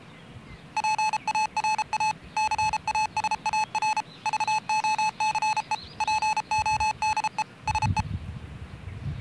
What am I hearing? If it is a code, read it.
Morse code, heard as electronic beeps, machine-sent, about 33 wpm, 860 Hz, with the noise of a park. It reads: PARA CASAR VOCE PODE SE